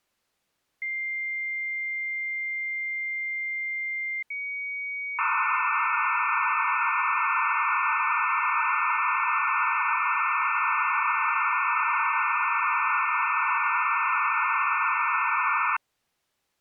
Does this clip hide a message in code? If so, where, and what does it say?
Yes: dial-up modem handshake (low-speed, two carriers) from 0.8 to 15.8 s, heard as two whistles, then hiss.